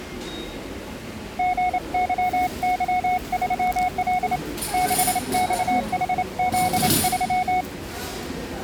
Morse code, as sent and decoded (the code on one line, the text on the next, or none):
--. -.-- -.-- ...-- .-.. / -.... -..- .... --.. ...--
GYY3L 6XHZ3